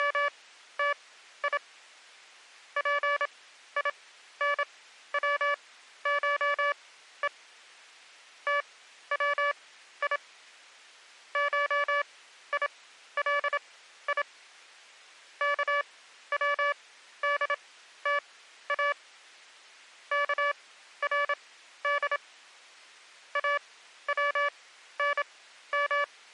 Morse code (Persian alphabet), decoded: … پینوشه توی شیلی کودتا کرد اونم

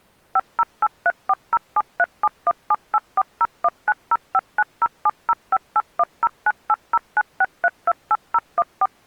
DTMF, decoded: 5083407371784019059070581098096328014

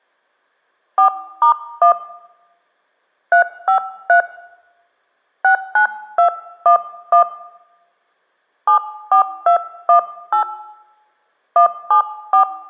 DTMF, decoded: 4*1 353 69211 74218 174

